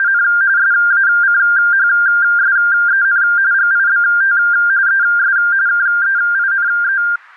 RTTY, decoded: … SACHSEN GIBT ES KEINE

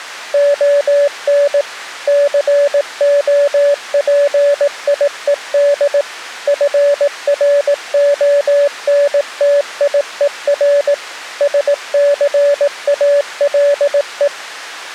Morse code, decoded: ON COPIED FRONTIER SCALE

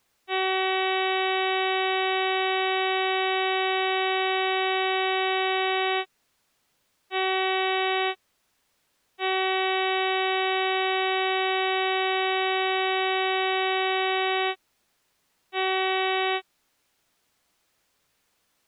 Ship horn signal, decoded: 1 long, 1 short, 1 long, 1 short

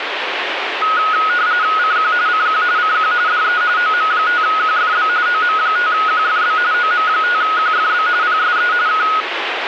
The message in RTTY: CQ CQ CQ DE OM5QFB OM5QFB OM5QFB PSE K

